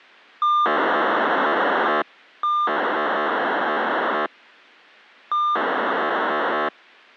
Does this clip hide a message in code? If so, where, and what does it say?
Yes: POCSAG pager data (2400 baud) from 0.4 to 6.7 s, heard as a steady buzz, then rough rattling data.